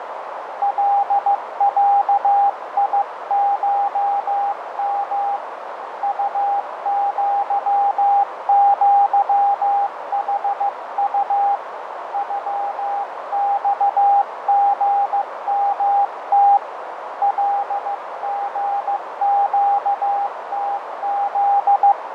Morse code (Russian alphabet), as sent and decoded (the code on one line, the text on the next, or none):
.-.. .-.- .. ---- -- / ..- --.-- --.-- .... ..- / ..-- -..- --. -- - / .-.. --. --.- - --..
ЛЯИШМ УЪЪХУ ЮЬГМТ ЛГЩТЗ